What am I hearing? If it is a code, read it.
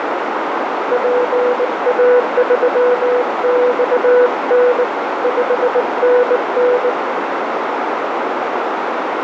Morse code, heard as a keyed tone, hand-sent with a bug key, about 19 wpm, 490 Hz, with heavy radio static and a narrow filter. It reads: PA3XN 5NN